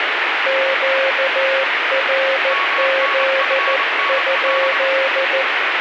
Morse code, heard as two keyed tones, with heavy radio static. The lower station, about 14 wpm, 540 Hz: QRZ?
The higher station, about 25 wpm, 1120 Hz: MNFNL